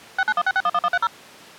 DTMF, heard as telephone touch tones, dialled by machine, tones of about 50 ms. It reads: 6916611130